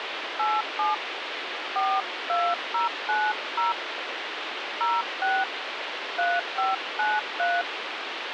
DTMF, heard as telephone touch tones, dialled by hand, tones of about 190 ms, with phone line noise. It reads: 87 42090 06 3593